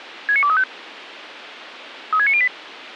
Five-tone selective call (ZVEI), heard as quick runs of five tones, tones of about 70 ms, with radio hiss and a squelch burst at the end. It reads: 69235 36908